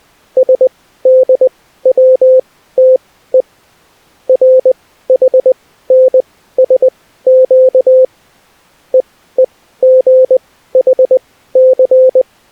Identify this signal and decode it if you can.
Morse code (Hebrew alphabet), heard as a keyed tone, machine-sent, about 20 wpm, spaced as for 14 wpm, 520 Hz. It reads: שדצתו רחנשק ווגחס